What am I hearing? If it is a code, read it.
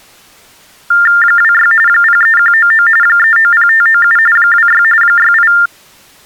TTY/TDD text telephone tones (45.45 baud Baudot), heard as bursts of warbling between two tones, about 400 Hz shift, 1600 Hz centre. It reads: 26 03199 390597 26 68